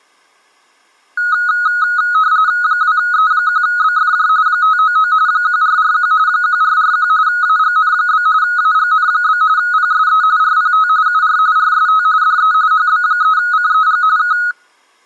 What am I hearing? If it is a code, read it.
RTTY (45.45 baud, 170 Hz shift), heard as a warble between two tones, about 1360 Hz centre. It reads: 2E1BFJ 599 1441 1441 AGN? AGN? PSE RPT UR RST DE HB3CEG K